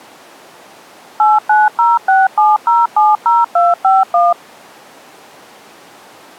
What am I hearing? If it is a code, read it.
DTMF, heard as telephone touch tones, dialled by machine, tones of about 190 ms. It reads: 89067070251